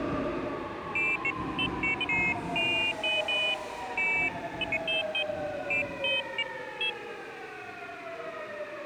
Pairs of high tones at irregular times, with the noise of a subway station. There is no code.